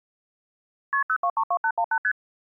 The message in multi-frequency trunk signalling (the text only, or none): KP 0232818 ST